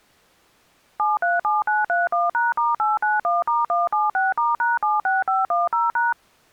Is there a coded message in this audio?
Yes: DTMF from 1.0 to 6.1 s, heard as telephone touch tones, dialled by machine, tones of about 170 ms. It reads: 737931#*891*176*#76510#